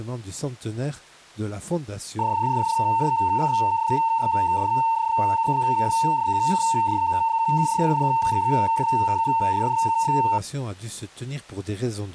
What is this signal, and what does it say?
PSK31 (31.25 baud), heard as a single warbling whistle, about 910 Hz.